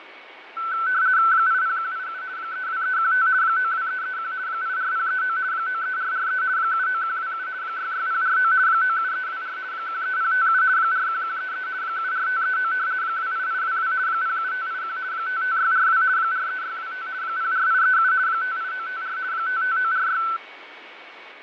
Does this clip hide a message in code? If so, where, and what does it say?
Yes: RTTY (50 baud, 170 Hz shift) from 0.6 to 20.4 s, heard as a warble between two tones, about 1420 Hz centre, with radio static, fading and a steady whistle near 2240 Hz. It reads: 80187 32315 92331 84039 93443 79127 66049 97324 13057 41133 74539 28822 07581 55642 43625 04837 58954 55946